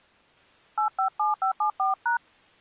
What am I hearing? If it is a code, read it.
DTMF, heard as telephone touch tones, dialled by hand, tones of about 140 ms. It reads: 857574#